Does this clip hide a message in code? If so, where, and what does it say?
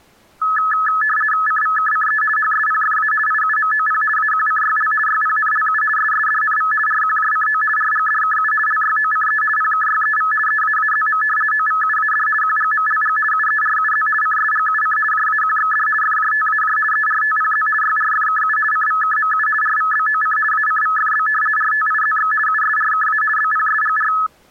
Yes: RTTY (50 baud, 450 Hz shift) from 0.4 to 24.3 s, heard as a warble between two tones, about 1500 Hz centre. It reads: CVKCE HSPFA IUMOP AQCYL YPNLU SSDNV RQJCO RGDKU LYOCE PKYEV EAAZM OVUAD QGMLG UERUZ CSGUC JAQXD FJTAJ ERTPZ YRFKU CVKMU RVBOC ACVFB RTIZX USRKA BPSGR